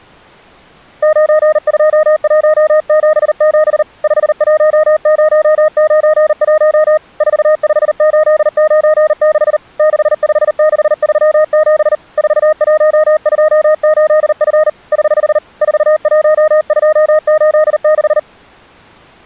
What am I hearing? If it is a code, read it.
Morse code, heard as a keyed tone, hand-sent with a paddle, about 39 wpm, 620 Hz. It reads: 92177 51091 45896 65637 4128F <HH> 41286